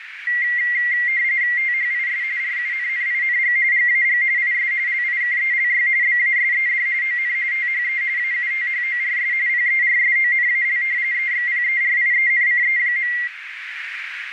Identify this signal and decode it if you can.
RTTY (45.45 baud, 170 Hz shift), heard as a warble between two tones, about 2000 Hz centre, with radio static and a narrow filter. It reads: THIS RUNNING GAG IS LIKELY BASED ON THE AUTHORS PERSONAL EXPERIENCE.